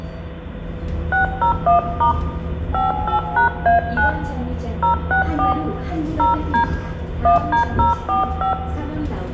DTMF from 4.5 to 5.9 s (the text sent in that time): 064